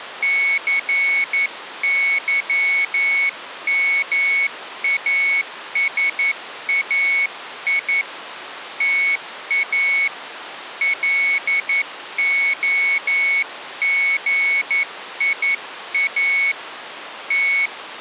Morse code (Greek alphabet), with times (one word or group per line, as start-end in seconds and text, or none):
0.2-8.0 ΘΥΜΑΣΑΙ
8.8-10.1 ΤΑ
10.8-16.5 ΛΟΓΙΑ
17.3-18.0 …